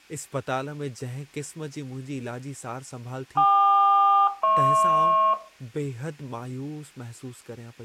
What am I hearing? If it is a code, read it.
Aircraft SELCAL, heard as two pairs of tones, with room echo and speech in Sindhi. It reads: KQ-HP